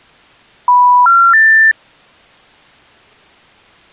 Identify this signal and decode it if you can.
Telephone call progress tone (North American plan), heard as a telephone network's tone, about 980, 1370, 1800 Hz. Special information tone.